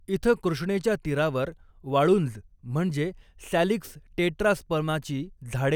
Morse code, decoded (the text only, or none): none